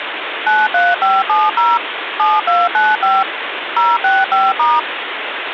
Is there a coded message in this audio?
Yes: DTMF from 0.5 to 4.8 s, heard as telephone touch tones, dialled by machine, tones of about 200 ms, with phone line noise. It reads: 93570 7295 065*